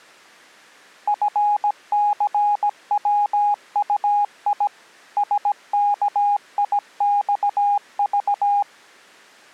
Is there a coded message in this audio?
Yes: Morse code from 1.0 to 8.7 s, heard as a keyed tone, machine-sent, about 17 wpm, 820 Hz. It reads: FCWUI SKIXV